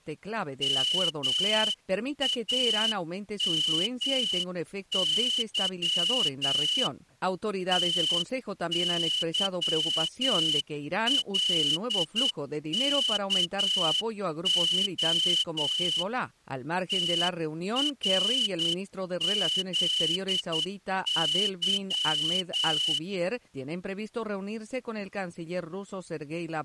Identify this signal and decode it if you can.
Morse code, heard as a whistle, hand-sent with a straight key, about 9 wpm. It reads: MAMY TYLKO TRZY